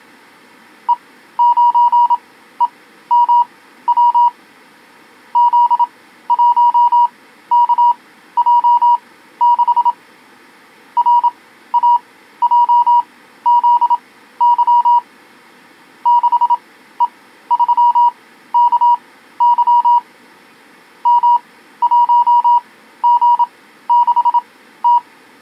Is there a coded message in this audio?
Yes: Morse code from 0.8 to 25.0 s, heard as a keyed tone, machine-sent, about 27 wpm, spaced as for 14 wpm, 960 Hz. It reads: E9EMW Z1KJ6 RAJZY 6E3KY M1G6T